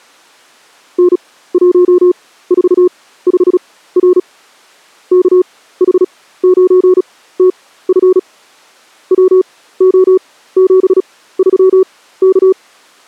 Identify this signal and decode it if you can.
Morse code, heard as a keyed tone, machine-sent, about 36 wpm, spaced as for 17 wpm, 370 Hz. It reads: N145R KH9TF WO73K